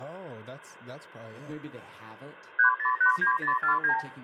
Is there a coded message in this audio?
Yes: multi-frequency trunk signalling (R2, with the far end's replies) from 2.6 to 4.0 s, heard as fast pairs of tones, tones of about 100 ms, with room echo and speech in English. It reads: 3089049